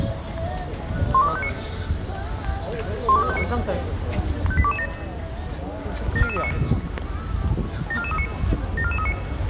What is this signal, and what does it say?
Five-tone selective call (ZVEI), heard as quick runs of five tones, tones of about 70 ms, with street noise. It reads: 12359 12359 58227 74439 74439 74439